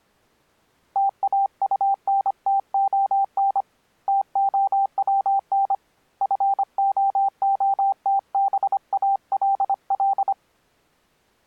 Morse code, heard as a keyed tone, hand-sent with a paddle, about 25 wpm, 790 Hz. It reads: TAUNTON TOWN FOOTBALL